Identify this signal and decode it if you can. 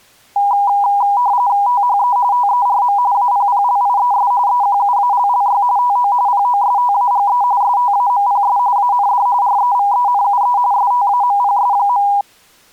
RTTY (45.45 baud, 170 Hz shift), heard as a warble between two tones, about 890 Hz centre. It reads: THE TERM APPLIES EQUALLY TO POSTAGE STAMPS AND REVENUE STAMPS.